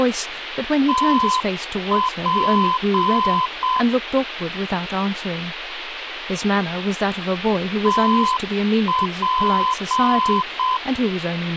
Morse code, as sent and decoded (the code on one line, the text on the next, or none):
- .--. / - .--.
TP TP